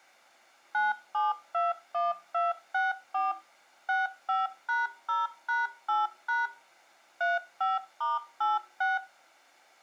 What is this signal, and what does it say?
DTMF, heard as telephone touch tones, dialled by machine, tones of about 170 ms. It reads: 9721264 65#0#8# 35*86